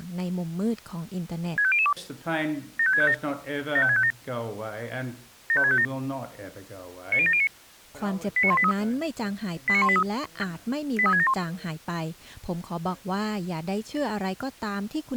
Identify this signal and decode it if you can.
Five-tone selective call (ZVEI), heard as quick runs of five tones, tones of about 70 ms, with speech in Thai. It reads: 65002 75657 75657 75657 90709 89183 89183 83671